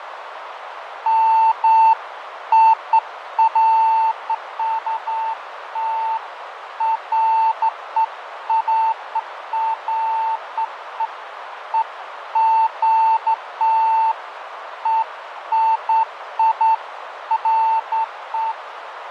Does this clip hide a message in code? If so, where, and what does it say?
No, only beeps of irregular length, with radio static, fading and a narrow filter.